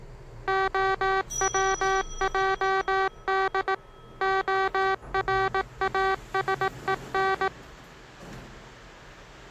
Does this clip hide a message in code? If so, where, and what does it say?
Yes: Morse code (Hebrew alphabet) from 0.4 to 7.5 s, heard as electronic beeps, machine-sent, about 18 wpm, 380 Hz, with the noise inside a lift. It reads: הצעד הראשון